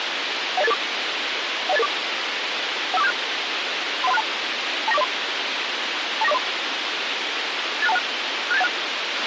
Five-tone selective call (EIA), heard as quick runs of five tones, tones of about 30 ms, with radio hiss and a squelch burst at the end. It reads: 10884 10884 15476 31362 29403 29403 86216 67816